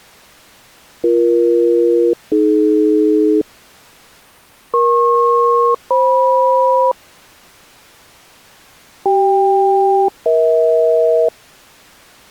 Aircraft SELCAL, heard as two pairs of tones. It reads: BE-AD EP-FM CK-EH